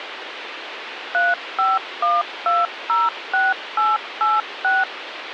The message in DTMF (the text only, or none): 351206886